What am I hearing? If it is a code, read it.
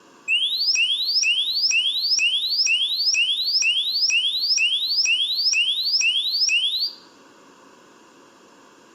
A tone that sweeps in pitch again and again, with room echo. There is no code.